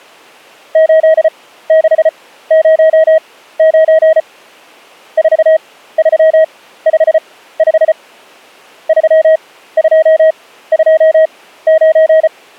Morse code, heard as a keyed tone, machine-sent, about 34 wpm, spaced as for 16 wpm, 640 Hz. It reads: 8609 4355 3229